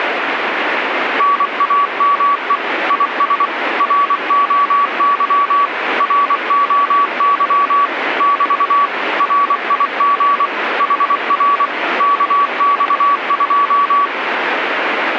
Morse code, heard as a keyed tone, machine-sent, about 24 wpm, 1140 Hz, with radio static. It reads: NAME IS ROY ROY <BT> RIG HR KX2